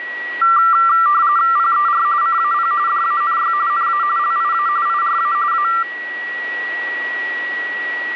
RTTY (45.45 baud, 170 Hz shift), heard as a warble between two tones, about 1260 Hz centre, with a steady whistle near 1930 Hz. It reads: PER CAP DANY NA LIA IRA A